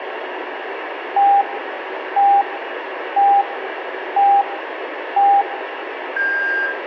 Radio time signal (five pips and a higher one, as on Chinese radio), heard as pips, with radio static and room echo.